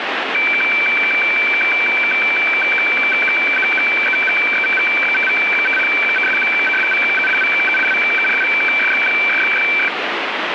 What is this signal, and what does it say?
Weather fax (radiofax), 120 lines a minute, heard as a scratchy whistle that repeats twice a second, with radio static.